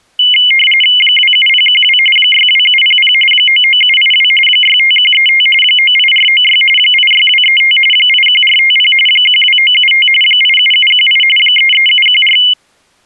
RTTY (45.45 baud, 850 Hz shift), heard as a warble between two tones, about 2550 Hz centre. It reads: 27012 62700 99782 65135 98496 86235 81450 12975 87718 33714